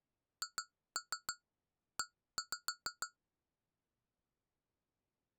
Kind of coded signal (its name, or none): tap code